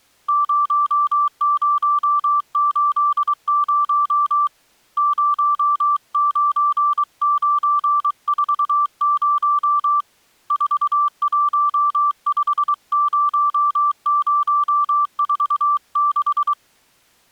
Morse code, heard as a keyed tone, hand-sent with a paddle, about 23 wpm, 1170 Hz. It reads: 0080 09940 4150046